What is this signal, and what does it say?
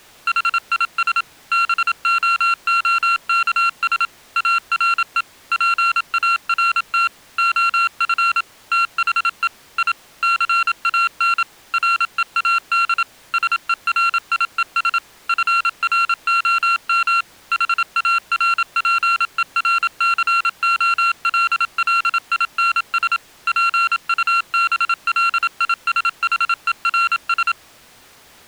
Morse code, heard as electronic beeps, machine-sent, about 27 wpm, 1370 Hz. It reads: HIS BOOKS ARE PART OF THE I CAN READ SERIES FROM HARPERCOLLINS PUBLISHERS